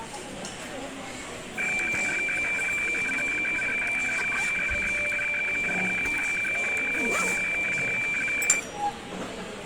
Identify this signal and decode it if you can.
Weather fax (radiofax), 120 lines a minute, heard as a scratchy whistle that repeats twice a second, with radio static and the noise of a restaurant.